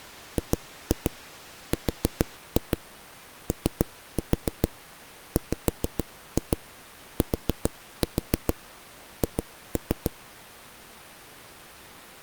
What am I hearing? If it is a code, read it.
Tap code, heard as knocks on a wall, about 6 knocks a second. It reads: GROWTH